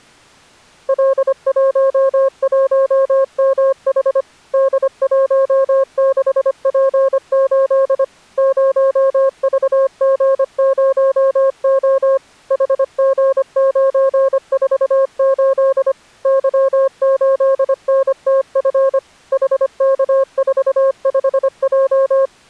Morse code, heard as a keyed tone, machine-sent, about 25 wpm, 540 Hz. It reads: L11MH D16P8 0VG0O HG948 Y8NTF HK45J